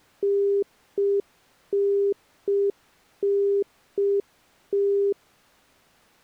Telephone call progress tone (UK plan), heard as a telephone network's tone, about 400 Hz. Congestion tone.